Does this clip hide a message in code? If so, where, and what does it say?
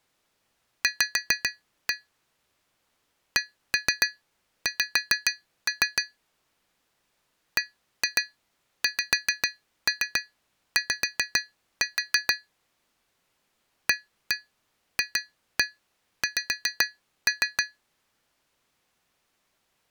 Yes: tap code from 0.8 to 17.8 s, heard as taps on glass, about 7 knocks a second. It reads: V CX BXY AFX